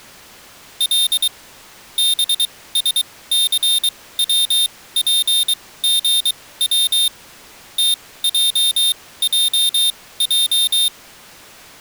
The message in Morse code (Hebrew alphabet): ל בשסצפגץ תעעע

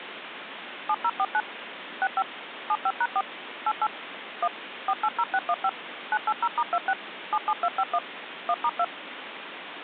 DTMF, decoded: 7049 65 75#4 88 1 480615 980*26 77251 1*2

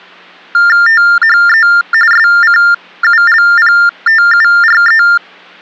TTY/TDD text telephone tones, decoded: THE SCULPTURE

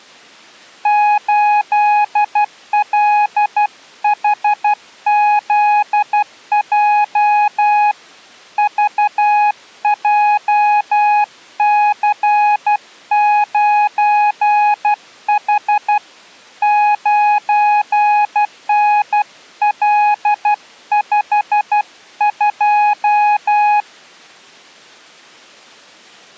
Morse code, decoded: 8LHZJ VJC9H 9NL52

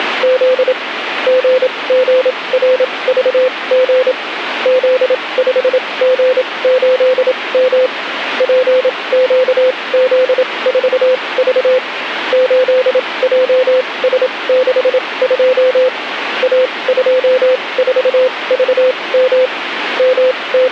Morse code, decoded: … GGRVG Z5G8M PQZ4V 8JS62 A24VM …

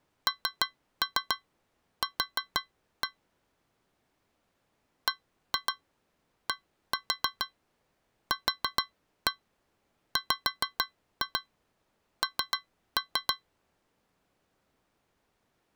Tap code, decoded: NQ BDQWN

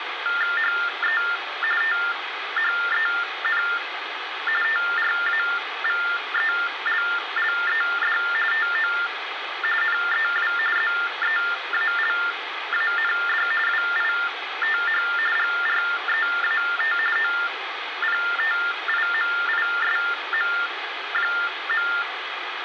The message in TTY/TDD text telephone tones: HE THEN TRAVELLED TO NEW ZEALAND WITH GREAT OPTIMISM.

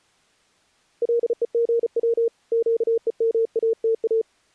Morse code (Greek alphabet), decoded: ΛΕΓΩ ΨΕΜΑΤΑ

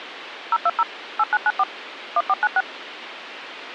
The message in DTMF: 020 8994 1496

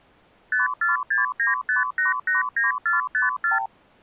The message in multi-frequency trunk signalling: 54695889454

